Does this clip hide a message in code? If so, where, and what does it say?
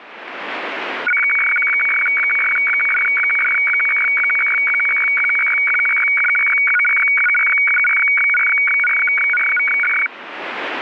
Yes: weather fax (radiofax), 120 lines a minute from 1.1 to 10.1 s, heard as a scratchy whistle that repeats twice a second.